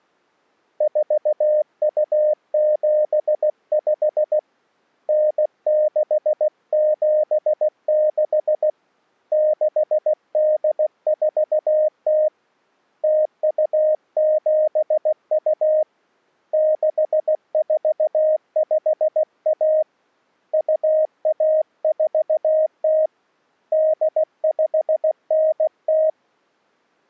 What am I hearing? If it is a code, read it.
Morse code (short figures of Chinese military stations), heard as a keyed tone, hand-sent with a paddle, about 16 wpm, 620 Hz. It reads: 4275 9676 6840 0272 6451 2140 8590